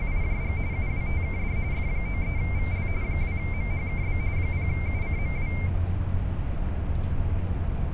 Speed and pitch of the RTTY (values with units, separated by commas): 45.45 baud, 170 Hz shift, 2200 Hz centre